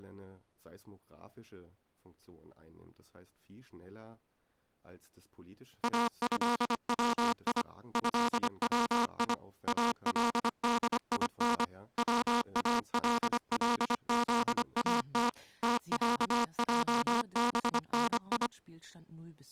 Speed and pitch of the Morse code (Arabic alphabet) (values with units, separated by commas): 25 wpm